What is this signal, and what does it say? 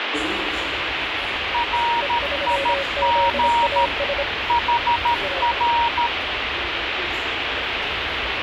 Morse code, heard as two keyed tones, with radio static and the noise of a subway station. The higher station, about 13 wpm, 940 Hz: RIG HR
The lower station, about 26 wpm, 550 Hz: E3ZAS